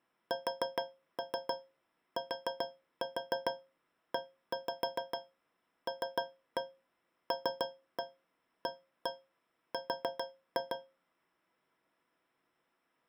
Tap code, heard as taps on a metal pipe, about 7 knocks a second. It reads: STELLAR